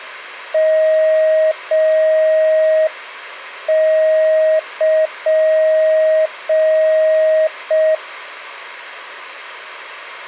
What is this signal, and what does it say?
Morse code (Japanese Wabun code), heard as a keyed tone, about 5 wpm, 630 Hz. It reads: ヨル